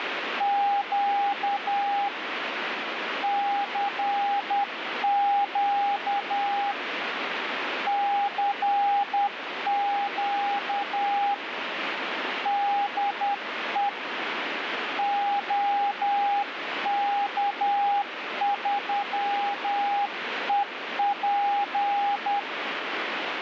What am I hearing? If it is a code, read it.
Morse code, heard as a keyed tone, hand-sent with a paddle, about 10 wpm, 810 Hz, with radio static. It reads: … CQ CQ DE OK3EP